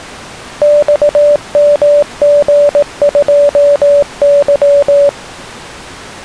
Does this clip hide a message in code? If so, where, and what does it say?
Yes: Morse code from 0.6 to 5.2 s, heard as a keyed tone, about 18 wpm, 580 Hz. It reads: XMG2Y